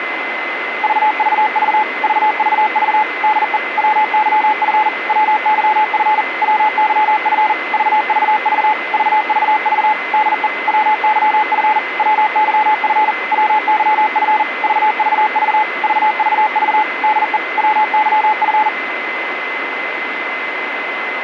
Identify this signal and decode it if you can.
Morse code, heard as a keyed tone, machine-sent, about 40 wpm, 860 Hz, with radio static and a steady whistle near 2050 Hz. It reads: VVV VVV DE WYF WYF WYF VVV VVV DE WYF WYF WYF VVV VVV DE WYF